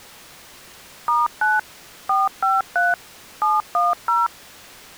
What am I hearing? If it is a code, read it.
DTMF, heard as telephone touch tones, dialled by machine, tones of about 180 ms. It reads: *9 453 710